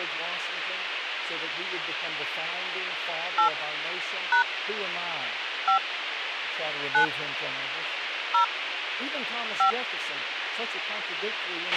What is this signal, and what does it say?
DTMF, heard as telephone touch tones, dialled by hand, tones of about 100 ms, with radio hiss, a squelch burst at the end and speech in English. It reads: 8 # 5 9 0 5